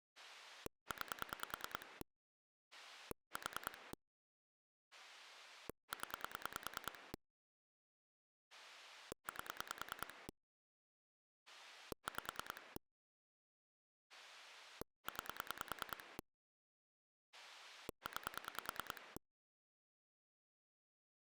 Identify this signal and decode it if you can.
Pulse dialling, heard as a rotary dial, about 10 pulses a second. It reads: 9 4 0 8 5 9 9